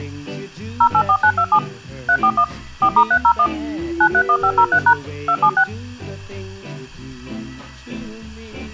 DTMF, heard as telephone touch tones, dialled by machine, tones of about 70 ms. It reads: 084927 341 4*301 931503# 276